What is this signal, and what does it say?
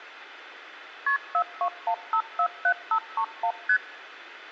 Multi-frequency trunk signalling (R1, as on North American trunks), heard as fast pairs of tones, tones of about 80 ms. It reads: KP 421547531 ST